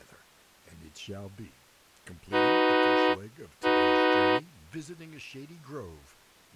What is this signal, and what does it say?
Train horn signal, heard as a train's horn, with speech in English. 2 short. On North American railways: a signal is acknowledged.